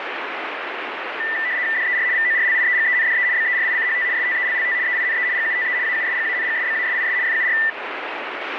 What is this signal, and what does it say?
RTTY (75 baud, 170 Hz shift), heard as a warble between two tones, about 1900 Hz centre, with radio static. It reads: DER VORLIEGENDE BERICHT STELLT EINE GUTE AUSGANGSBASIS FUR